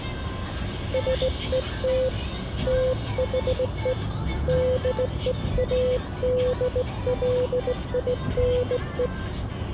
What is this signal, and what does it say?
Morse code, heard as a keyed tone, hand-sent with a straight key, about 17 wpm, 510 Hz, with the noise inside a bus. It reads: SET THE DEADLINE